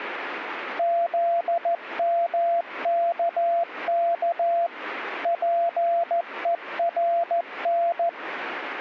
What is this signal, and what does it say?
Morse code, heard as a keyed tone, machine-sent, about 14 wpm, 680 Hz. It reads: ZMKK PERN